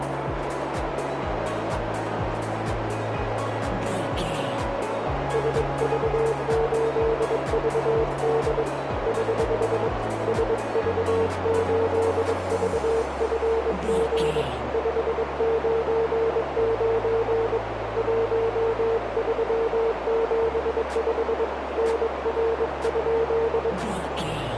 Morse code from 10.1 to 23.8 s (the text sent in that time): SV8VFG 599 1375 NR?